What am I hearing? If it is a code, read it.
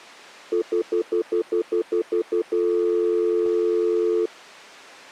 Telephone call progress tone (North American plan), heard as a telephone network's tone, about 350, 440 Hz, 0.1 s on and 0.1 s off. Stutter dial tone.